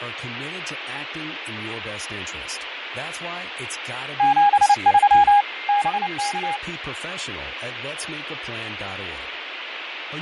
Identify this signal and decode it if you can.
Morse code, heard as a keyed tone, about 29 wpm, 820 Hz, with radio static, fading, a weaker station near 2110 Hz and speech in English. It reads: 73 BK